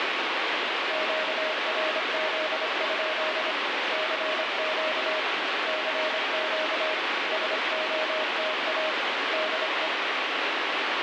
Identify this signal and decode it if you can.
Morse code, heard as a keyed tone, hand-sent with a paddle, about 26 wpm, 620 Hz, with heavy radio static. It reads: QRZ? CQ CQ SOTA DE